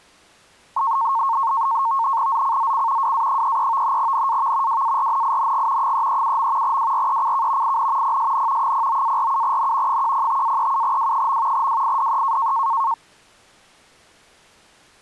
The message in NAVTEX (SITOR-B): ZCZC WA33 NAV WARNING 337. WRECK IN PSN 09-47N 105-37W. WIDE

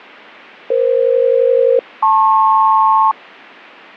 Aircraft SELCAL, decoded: EF-LP

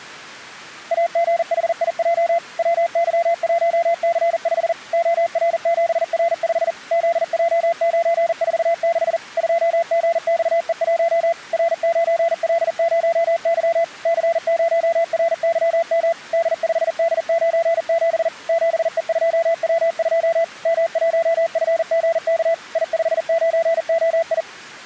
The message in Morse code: AGHIJ WY1C5 OR7R5 ZJ946 2GXE1 R9L0Y C0RYM D5D97 7E2W2 M1FGK I59OI

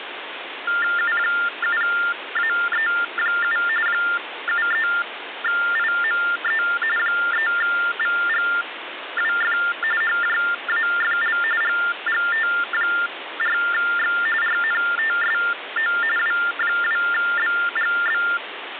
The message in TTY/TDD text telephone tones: U7AE7 73IME 3VGWF HJAFL GGT4X RNTSO W2BGB

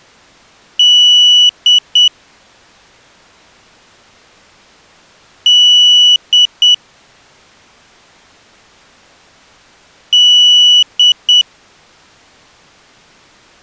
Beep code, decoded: 1 long, 2 short

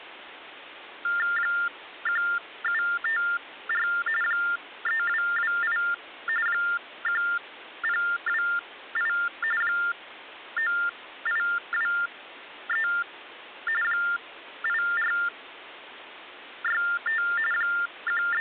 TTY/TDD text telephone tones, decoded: 1754 3228 1028 9823 8465 …

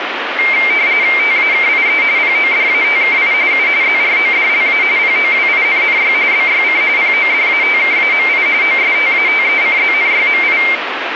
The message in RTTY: TAKIE PODATKI U ZRODLA POWINNY BYC PODATKAMI OSTATECZNYMI

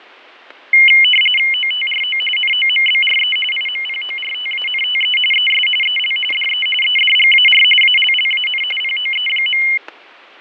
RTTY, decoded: OTRO NOMBRE IMPORTANTE ES EL DE EDGAR ALLAN POE.

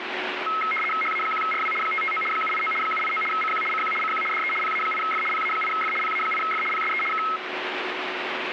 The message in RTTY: HA1RW 559 789 789 CQ CQ CQ DE PA8F PA8F PA8F PSE K

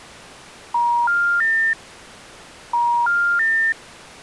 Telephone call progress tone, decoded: special information tone

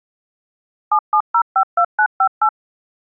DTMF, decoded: 77052958

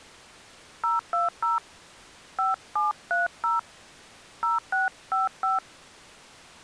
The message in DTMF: 020 5730 0655

